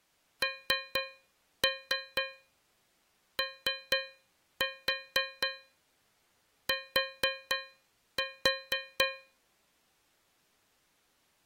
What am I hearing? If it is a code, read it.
Tap code, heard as taps on a metal pipe, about 4 knocks a second. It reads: NOT